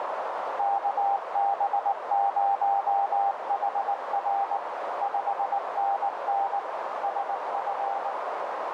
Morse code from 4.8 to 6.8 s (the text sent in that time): 5NN